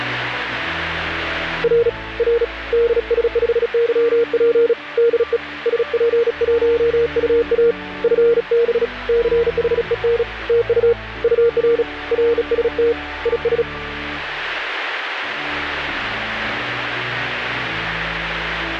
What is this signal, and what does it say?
Morse code, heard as a keyed tone, hand-sent with a bug key, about 36 wpm, 470 Hz. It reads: R R DS5YP DE SP1UA FB CHEN TU UR RST IS